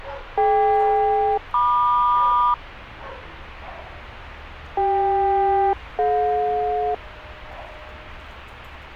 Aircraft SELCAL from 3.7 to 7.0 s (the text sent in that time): CK-DJ